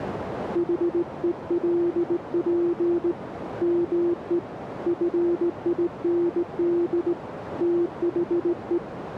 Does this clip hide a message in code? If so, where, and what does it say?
Yes: Morse code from 0.5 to 8.8 s, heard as a keyed tone, hand-sent with a straight key, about 18 wpm, 340 Hz, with radio static and a narrow filter. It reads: HELP ME FIND THE